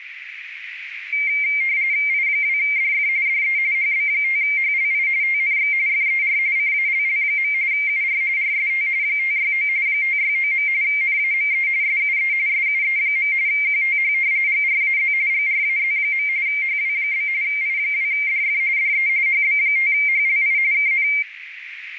RTTY (45.45 baud, 170 Hz shift), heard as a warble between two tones, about 2200 Hz centre, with radio static and a narrow filter. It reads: I2DF DE HB5HLI TNX FER CALL. UR RST 569 569. NAME SUE SUE. QTH GRAZ GRAZ. HW? I2DF DE HB5HLI KN